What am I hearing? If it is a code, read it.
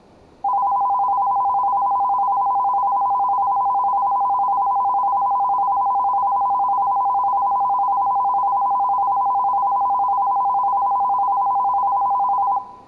A tone that alternates evenly between two pitches, with room echo. There is no code.